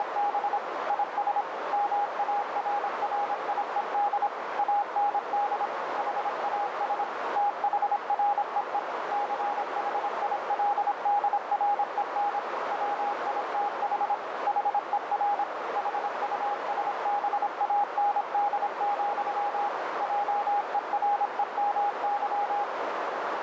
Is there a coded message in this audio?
Yes: Morse code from 0.0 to 22.7 s, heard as a keyed tone, machine-sent, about 26 wpm, 820 Hz, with heavy radio static and a narrow filter. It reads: … IS MARRIED AND HAS THREE CHILDREN WITH HER HUSBAND, JEREMY